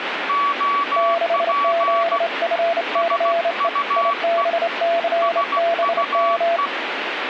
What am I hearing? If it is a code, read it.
Morse code, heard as two keyed tones, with radio static. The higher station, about 16 wpm, 1140 Hz: OP SUE SUE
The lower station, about 28 wpm, 680 Hz: 6ZFCE IBCBM